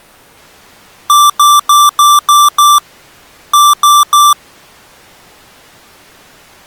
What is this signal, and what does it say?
Beep code, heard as beeps from a small speaker, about 1170 Hz. 6-3.